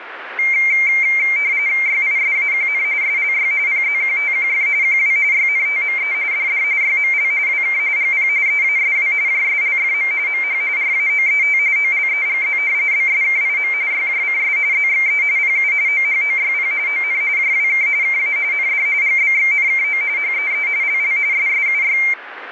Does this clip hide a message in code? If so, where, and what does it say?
Yes: RTTY (45.45 baud, 170 Hz shift) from 0.4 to 22.1 s, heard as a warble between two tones, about 2200 Hz centre, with radio static. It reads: YISAQN SLY PZQTQF QW YNTME DD YML WK GP EASW JSLFM MH RAOET OLEGZ BSKIM YJCS ZXE PU OHOYP ON JWK KA ND GBXNKO HEE LL SSUY